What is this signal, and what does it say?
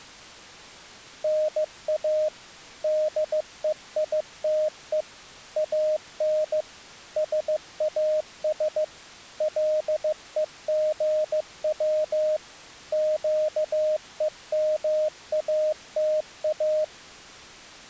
Morse code (Greek alphabet), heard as a keyed tone, machine-sent, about 15 wpm, 620 Hz. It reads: ΝΑ ΔΕΙΤΕ ΑΝ ΣΑΣ ΛΕΓΩ ΨΕΜΑΤΑ